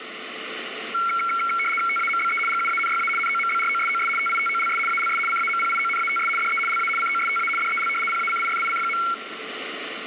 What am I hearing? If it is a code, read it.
RTTY (75 baud, 850 Hz shift), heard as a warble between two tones, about 1800 Hz centre, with radio static. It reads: TAMBE GUANYA NOMBROSOS TITOLS ALS CAMPIONATS DE LA COSTA DEL PACIFIC.